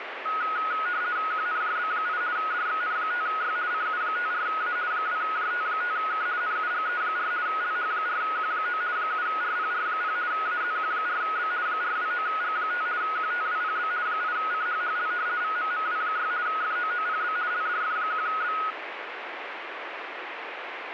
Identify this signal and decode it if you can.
RTTY (50 baud, 170 Hz shift), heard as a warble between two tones, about 1360 Hz centre, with radio static. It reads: QNJB8 DXN5Y CU54A 2JT5K NUGE4 LH4Q9 7RPR0 AZQ4B 429G5 QTWPB 8CHHL VMMW6 FOOPB LDF1B